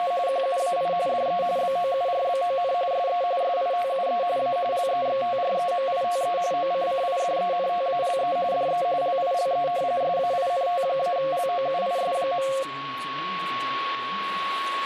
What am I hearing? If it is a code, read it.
RTTY (45.45 baud, 170 Hz shift), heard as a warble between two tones, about 620 Hz centre, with radio static and a steady whistle near 1110 Hz. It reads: … QUAI DE BOURBON SE SITUE A LEXTREMITE OCCIDENTALE DE LILE SAINT-LOUIS.